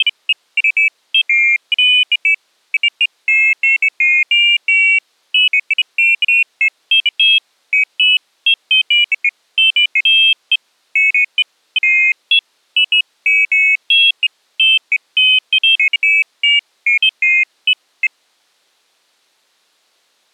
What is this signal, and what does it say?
Pairs of high tones at irregular times. There is no code.